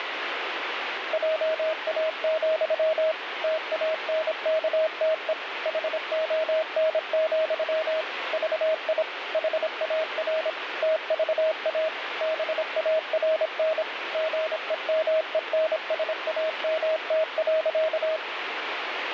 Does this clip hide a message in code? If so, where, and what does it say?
Yes: Morse code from 1.1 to 18.2 s, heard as a keyed tone, machine-sent, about 26 wpm, 630 Hz, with radio static. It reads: JA, TANKTE HON, VI HAR TVA BARN GEMENSAMT.